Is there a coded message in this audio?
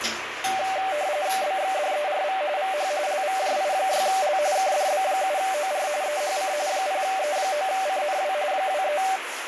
Yes: RTTY (45.45 baud, 170 Hz shift) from 0.4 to 9.2 s, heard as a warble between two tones, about 680 Hz centre, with radio static and the noise of a restroom. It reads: BXDERV VH LVJI6L KDB7OR EHC 0E9CNW 23